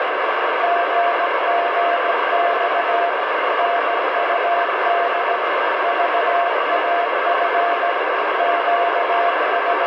Morse code, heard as a keyed tone, machine-sent, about 17 wpm, 690 Hz, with heavy radio static. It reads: GGX NUD VAF …